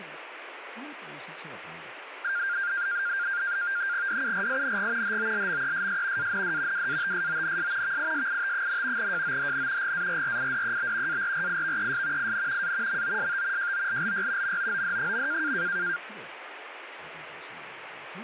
NAVTEX (SITOR-B), 100 baud, 170 Hz shift, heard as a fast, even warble, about 1500 Hz centre, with radio static and speech in Korean. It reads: DURING HOLMESS AND WATSONS VISIT, JOHN GARRIDEB ARRIVES IN A MOST JOLLY MOOD.